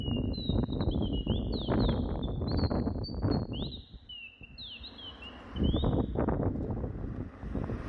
Bird-like chirps, with room echo and street noise. There is no code.